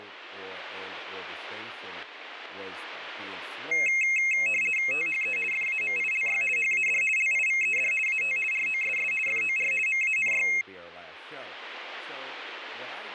RTTY (50 baud, 450 Hz shift), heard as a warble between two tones, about 2350 Hz centre, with speech in English. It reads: THE FAMILY HAD LIVED AT ROSS FOR MANY